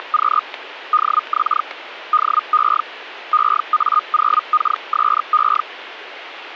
Hellschreiber (Feld-Hell, 122.5 baud), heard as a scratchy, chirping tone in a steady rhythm, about 1230 Hz. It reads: … DX DE EA0KSE